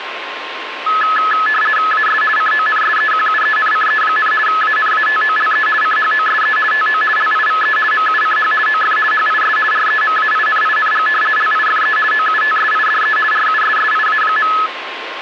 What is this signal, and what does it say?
RTTY (50 baud, 450 Hz shift), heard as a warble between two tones, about 1500 Hz centre, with radio static and a steady whistle near 1060 Hz. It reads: AS CONSEQUENCE, ANATOLE CHOSE TO LIVE MUCH OF HIS REMAINING LIFE OUTSIDE RUSSIA.